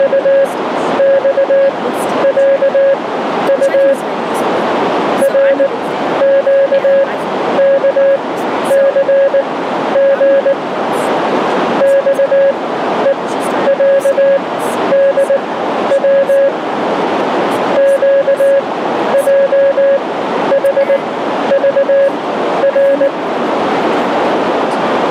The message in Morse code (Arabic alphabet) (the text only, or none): … رقكثغ صءعدو قجحضر